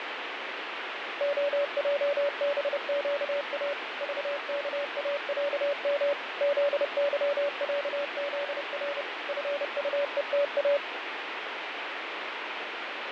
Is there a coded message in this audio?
Yes: Morse code (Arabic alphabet) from 1.1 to 10.8 s, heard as a keyed tone, machine-sent, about 30 wpm, 570 Hz, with radio static and fading. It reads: خجبقا ضكاعم ذظعذر فطءتا